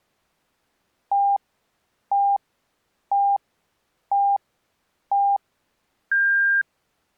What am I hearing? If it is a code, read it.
Radio time signal (five pips and a higher one, as on Chinese radio), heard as pips.